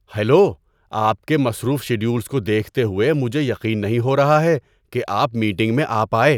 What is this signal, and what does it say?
Speech in Urdu. There is no code.